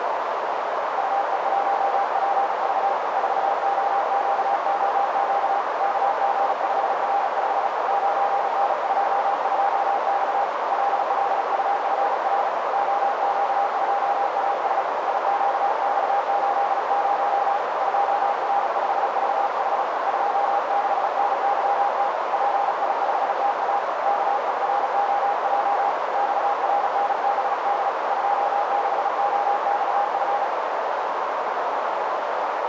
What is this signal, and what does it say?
Morse code, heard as a keyed tone, hand-sent with a paddle, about 36 wpm, 810 Hz, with heavy radio static and a narrow filter. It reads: UE1PV 4OQOQ KG5R5 9N22X LLUFR OQ2AS IQX80 2R5VH 26NYT PI5TA KEROJ XRNBD 26OXF